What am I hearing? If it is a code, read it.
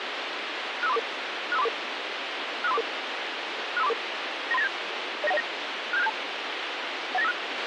Five-tone selective call (EIA), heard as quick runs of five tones, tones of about 30 ms, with radio hiss and a squelch burst at the end. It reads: 65344 65344 65344 65344 93987 09109 67672 18956